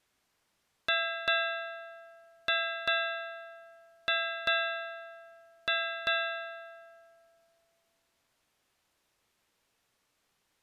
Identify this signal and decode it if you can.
Ship's bell, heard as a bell. 8. Eight half-hours of the watch have passed.